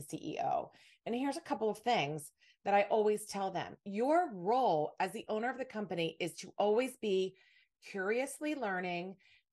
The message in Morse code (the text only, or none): none